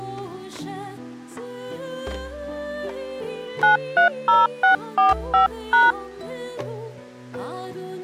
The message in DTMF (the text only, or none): 930645#